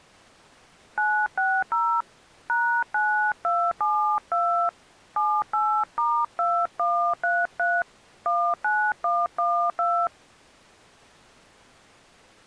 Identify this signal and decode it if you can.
DTMF, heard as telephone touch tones, dialled by hand, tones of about 300 ms. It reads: 960 #9272 78*2133 19112